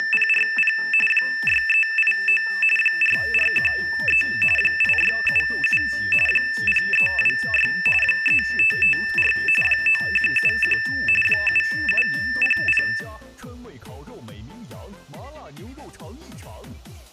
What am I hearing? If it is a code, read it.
RTTY (45.45 baud, 850 Hz shift), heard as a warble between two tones, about 2200 Hz centre. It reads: … 6389 4413 8677 0326 3554 9171 7700